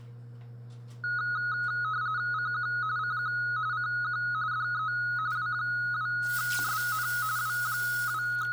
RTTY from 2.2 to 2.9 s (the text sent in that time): CQ